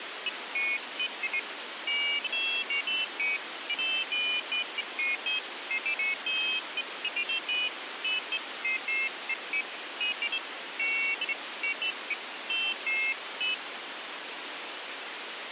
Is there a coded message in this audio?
No, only pairs of high tones at irregular times, with radio hiss.